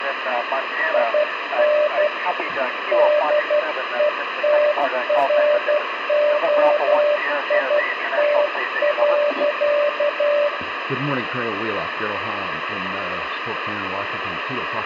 Morse code, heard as a keyed tone, hand-sent with a paddle, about 12 wpm, 590 Hz, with radio static. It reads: IN DETROIT.